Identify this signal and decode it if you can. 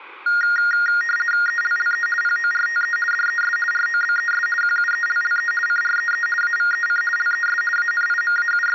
RTTY (50 baud, 450 Hz shift), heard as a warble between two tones, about 1650 Hz centre. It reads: ELLE PORTE DES ROBES QUELLE CREE AVEC LES …